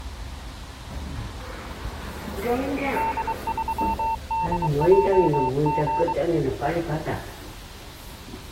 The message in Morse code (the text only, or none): D3DJG